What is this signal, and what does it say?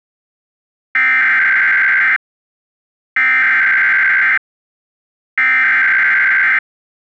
Emergency Alert System (SAME) tones (header bursts), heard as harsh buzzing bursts, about 520.83 baud.